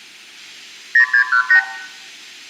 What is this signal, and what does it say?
Multi-frequency trunk signalling (R2, with the far end's replies), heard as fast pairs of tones, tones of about 90 ms, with room echo. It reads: 0618